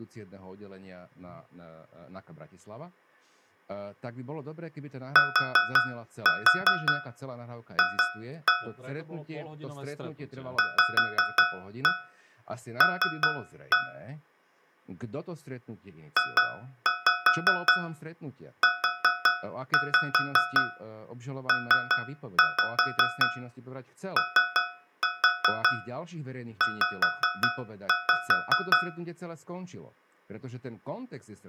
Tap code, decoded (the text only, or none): TF VL JUPOZ